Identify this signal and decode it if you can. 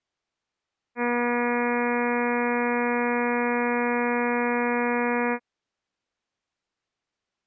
Ship horn signal, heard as a ship's horn, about 240 Hz. 1 long. At sea: a vessel nearing a blind bend, or under power and making way in fog.